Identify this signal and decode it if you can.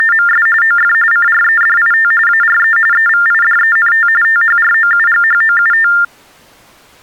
TTY/TDD text telephone tones (45.45 baud Baudot), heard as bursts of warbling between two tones, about 400 Hz shift, 1600 Hz centre. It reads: … OF CREDIT ARE EVIDENT THROUGHOUT